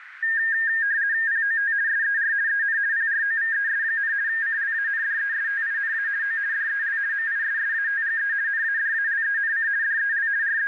RTTY (50 baud, 170 Hz shift), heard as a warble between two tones, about 1700 Hz centre, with radio static and a narrow filter. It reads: POT SER EN PROVES, CLANDESTINA O DEL MISSATGE NADALENC DEL …